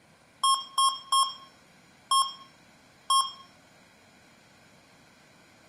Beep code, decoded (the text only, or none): 3-1-1